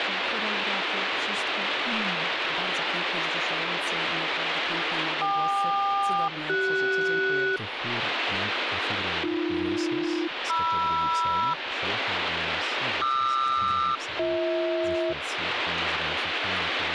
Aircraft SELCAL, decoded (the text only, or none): KQ-CS AB-MR QR-BH